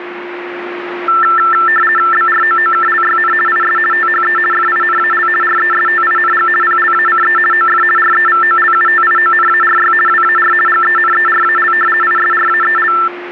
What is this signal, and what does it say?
RTTY (50 baud, 450 Hz shift), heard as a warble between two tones, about 1550 Hz centre, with radio static and a steady whistle near 350 Hz. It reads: BROOKLYN IS THE FINAL RESTING PLACE OF REVOLUTIONARY WAR GENERAL ISRAEL